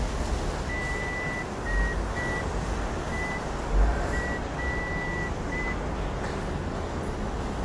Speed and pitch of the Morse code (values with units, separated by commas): 5 wpm